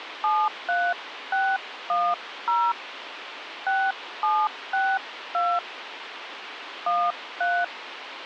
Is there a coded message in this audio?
Yes: DTMF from 0.2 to 7.6 s, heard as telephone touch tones, dialled by hand, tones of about 240 ms, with radio hiss. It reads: 73610 6762 13